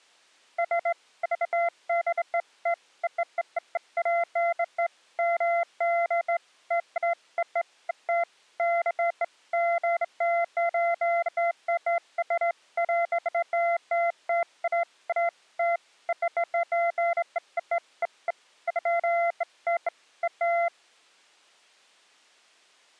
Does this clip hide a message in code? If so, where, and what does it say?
No, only beeps of irregular length.